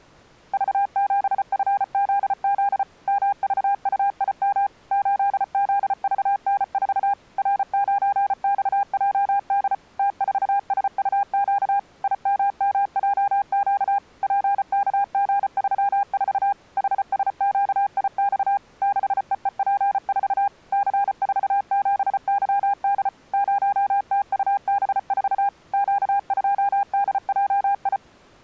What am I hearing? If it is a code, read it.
Morse code, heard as a keyed tone, machine-sent, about 34 wpm, 810 Hz. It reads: V7FZZ MVUIM 8ZVN4 R9XJD T4SUQ IMMJQ PKG34 HSQIX 6EEP4 C47YD 0TUB4 Q2DJI